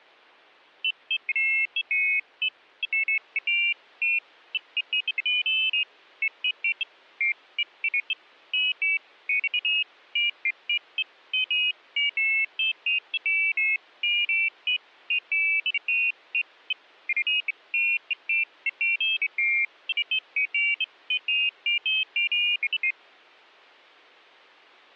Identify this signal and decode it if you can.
Pairs of high tones at irregular times. There is no code.